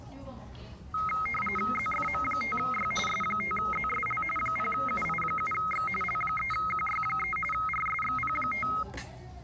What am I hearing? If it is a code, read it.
RTTY (45.45 baud, 850 Hz shift), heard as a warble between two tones, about 1700 Hz centre, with the noise of a restaurant. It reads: ZFM5Y S5ZSL 0UI7X L3QY3 RSXP5